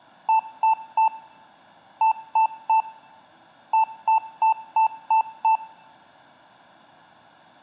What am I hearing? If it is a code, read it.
Beep code, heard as beeps from a small speaker, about 890 Hz, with room echo. 3-3-6.